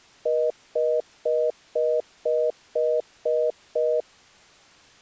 Telephone call progress tone (North American plan), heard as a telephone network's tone, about 480, 620 Hz, 0.25 s on and 0.25 s off. Congestion tone.